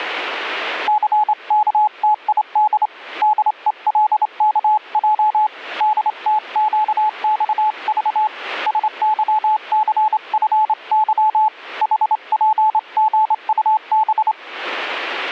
Morse code, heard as a keyed tone, hand-sent with a straight key, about 27 wpm, 860 Hz. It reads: CKTID DELKJ DTQXV SYCFY HPGUB